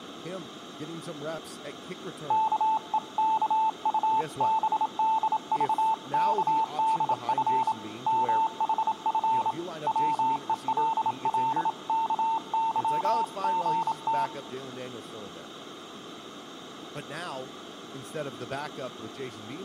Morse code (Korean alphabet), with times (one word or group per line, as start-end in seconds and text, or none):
2.3-7.7 아이들은
8.1-9.5 문
9.9-14.3 밖에서